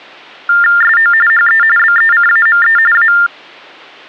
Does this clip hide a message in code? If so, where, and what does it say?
Yes: TTY/TDD text telephone tones (45.45 baud Baudot) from 0.5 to 3.3 s, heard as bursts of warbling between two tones, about 400 Hz shift, 1600 Hz centre. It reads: SO HE BECAME A